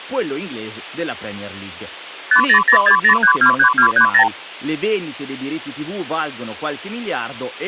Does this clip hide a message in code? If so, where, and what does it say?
Yes: multi-frequency trunk signalling (R2, with the far end's replies) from 2.3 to 4.3 s, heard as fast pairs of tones, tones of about 90 ms, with hum and speech in Italian. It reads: 50060323230